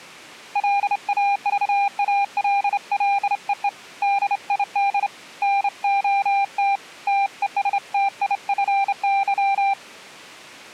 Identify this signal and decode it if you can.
Morse code, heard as a keyed tone, hand-sent with a straight key, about 28 wpm, 800 Hz. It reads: LAVALLEE DID NOT TESTIFY